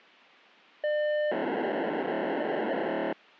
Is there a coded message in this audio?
Yes: POCSAG pager data (1200 baud) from 0.8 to 3.1 s, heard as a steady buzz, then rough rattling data.